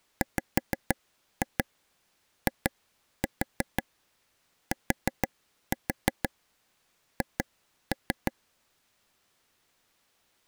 Tap code, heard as taps on a table, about 6 knocks a second. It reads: WITH